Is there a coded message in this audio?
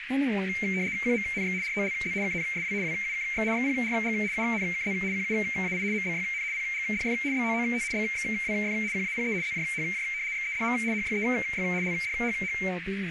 Yes: RTTY (75 baud, 170 Hz shift) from 0.5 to 12.7 s, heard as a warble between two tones, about 2200 Hz centre, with radio static, a narrow filter and speech in English. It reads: QMNX ROLZ KNSW WUKX XPRG UNKZ QUAI MBYN PGDF BOOT BXWF QAPE ZJHJ XEDM HYEY LDHH